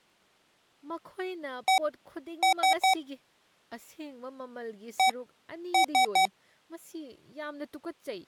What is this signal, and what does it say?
Beep code, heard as beeps from a small speaker, played twice, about 760 Hz, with speech in Manipuri. 1-3.